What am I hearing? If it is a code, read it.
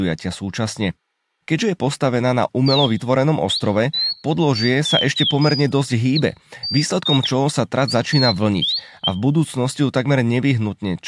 Bird-like chirps, with room echo and speech in Slovak. There is no code.